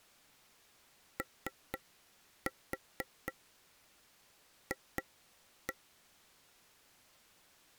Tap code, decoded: OF

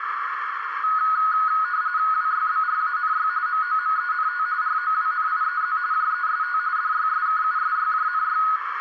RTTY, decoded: WYBRANY MOMENT ROWNIEZ JEST DYSKUSYJNY

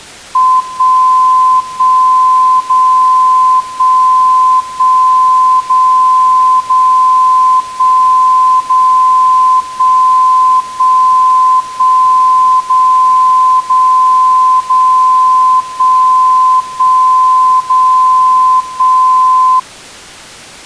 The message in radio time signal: 1 1 0 1 1 0 0 1 0 1 1 1 0 0 0 1 1 0 1

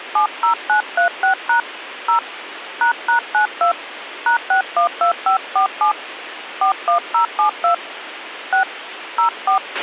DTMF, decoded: 70936# 0 ##92 #612547 41072 6 04

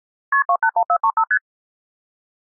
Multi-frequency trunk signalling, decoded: KP 281435 ST

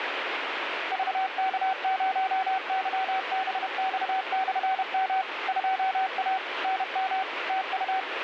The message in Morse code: VK0YBX/M 2A NM TU

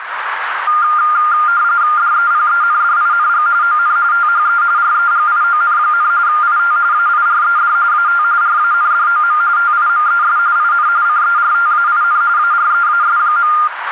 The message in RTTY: DEPENDING ON THE REGION, IT AIRED AT RANDOM TIMES IN CERTAIN AREAS.

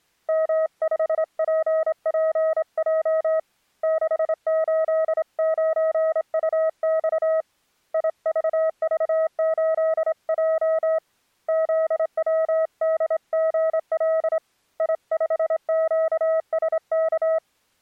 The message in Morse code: M5PPJ 689UX IVV8J ZWDGL I5QSK

